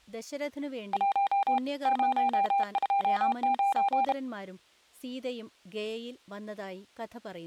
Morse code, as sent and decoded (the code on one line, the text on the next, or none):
.---- / ----- ..--- ----.
1 029